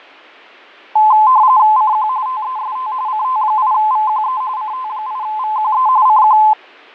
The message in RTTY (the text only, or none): CQ TEST CT8VQE CT8VQE CQ